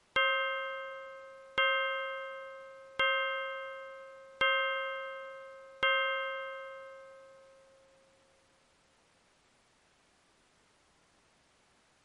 Clock strike, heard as a bell. 5. Five o'clock.